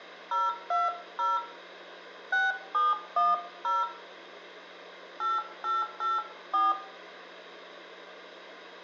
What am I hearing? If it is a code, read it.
DTMF, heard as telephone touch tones, dialled by hand, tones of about 180 ms, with hum and room echo. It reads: 020 6710 8884